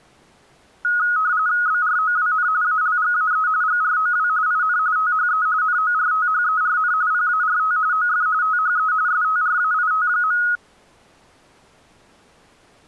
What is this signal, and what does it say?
RTTY (45.45 baud, 170 Hz shift), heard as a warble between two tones, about 1360 Hz centre. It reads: BROWN ALGAE GROW IN THE NORTHERN PART OF THE STRAIT.